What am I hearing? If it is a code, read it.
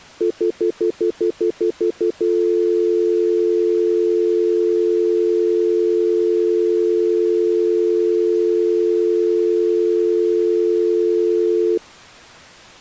Telephone call progress tone (North American plan), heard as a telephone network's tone, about 350, 440 Hz, 0.1 s on and 0.1 s off. Stutter dial tone.